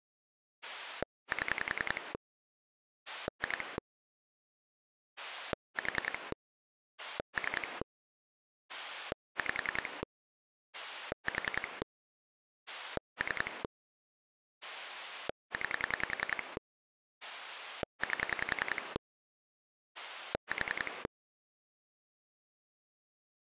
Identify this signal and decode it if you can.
Pulse dialling, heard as a rotary dial, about 10 pulses a second. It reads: 7 2 4 3 5 4 3 9 8 4